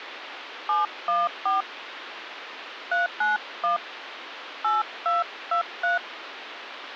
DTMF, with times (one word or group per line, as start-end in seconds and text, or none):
0.7-1.6 714
2.9-3.8 391
4.6-6.0 8223